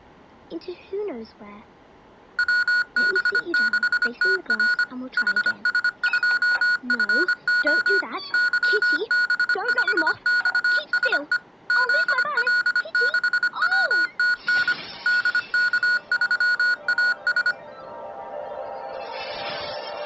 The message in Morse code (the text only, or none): WB6TR HS2FO YB5XSE ZL6WTN DK3AS